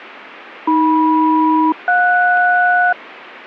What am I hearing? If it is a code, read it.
Aircraft SELCAL, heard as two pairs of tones. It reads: AM-JS